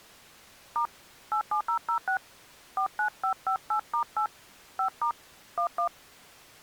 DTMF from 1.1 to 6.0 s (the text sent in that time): 87006 49558*8 5* 11